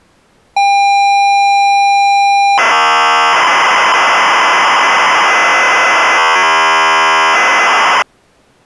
ZX Spectrum tape loading, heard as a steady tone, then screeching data.